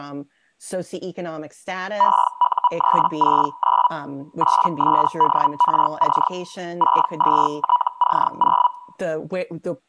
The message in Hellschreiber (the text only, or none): EU369 8SDRC 62TC0